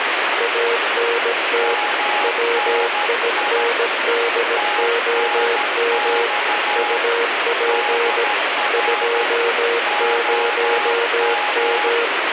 Morse code, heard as two keyed tones, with heavy radio static. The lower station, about 17 wpm, 470 Hz: ANT WINDOM UP 20M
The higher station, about 13 wpm, 830 Hz: MNI TNX DR OM